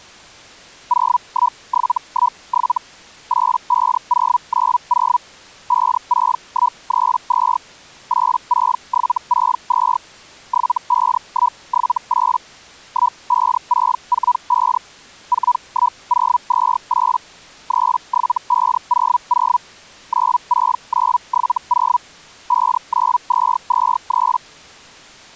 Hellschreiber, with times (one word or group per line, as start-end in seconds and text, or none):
0.9-2.8 01717
3.3-5.2 85090
5.7-7.6 56132
8.1-10.0 86762
10.5-12.4 75178
12.9-14.8 15645
15.3-17.2 41028
17.7-19.6 37500
20.1-22.0 96970
22.5-24.4 59223